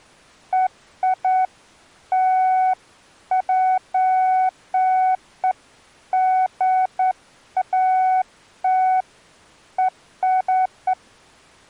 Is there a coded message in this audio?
No, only beeps of irregular length.